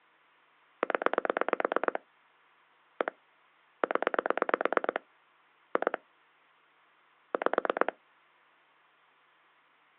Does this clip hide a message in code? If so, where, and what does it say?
Yes: pulse dialling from 0.8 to 7.9 s, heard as clicks on a phone line, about 9 pulses a second. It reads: 0 1 0 2 5